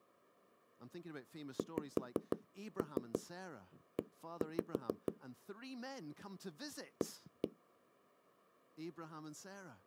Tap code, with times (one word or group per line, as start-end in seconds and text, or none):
1.6-5.1 XE
7.0-7.5 A